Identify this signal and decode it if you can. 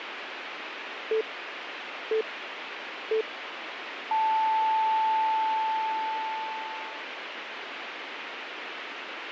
Radio time signal (three low pips and a long one an octave up, as on NHK), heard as pips, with radio hiss.